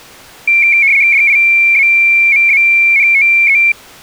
RTTY (75 baud, 170 Hz shift), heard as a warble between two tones, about 2250 Hz centre. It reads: DIAMANTE